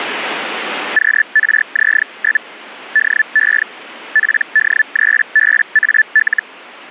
Hellschreiber (Feld-Hell, 122.5 baud), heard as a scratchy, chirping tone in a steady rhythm, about 1750 Hz, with radio static. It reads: QRZ? DE PD3BAL